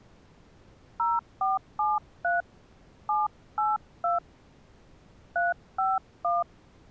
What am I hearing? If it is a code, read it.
DTMF, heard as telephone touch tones, dialled by hand, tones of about 180 ms. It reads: 0473 782 351